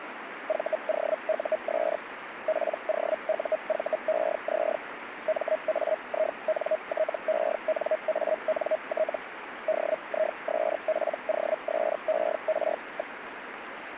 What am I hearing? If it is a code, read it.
Hellschreiber (Feld-Hell, 122.5 baud), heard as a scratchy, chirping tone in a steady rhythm, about 630 Hz, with radio static. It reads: VOUS POUVEZ MAINTENANT DISPOSER.